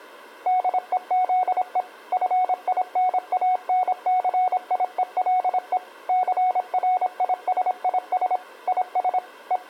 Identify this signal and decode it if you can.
Morse code, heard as a keyed tone, machine-sent, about 26 wpm, 740 Hz. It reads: DEZE FINANCIELE CRISIS IS …